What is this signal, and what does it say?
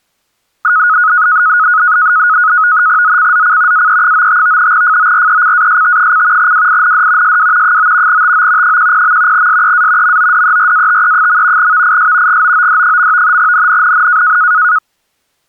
NAVTEX (SITOR-B), 100 baud, 170 Hz shift, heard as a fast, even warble, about 1360 Hz centre. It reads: ZCZC AE95 FORECAST: WIND SW 9 TO 10. SEA MODERATE. VIS GOOD. NNNN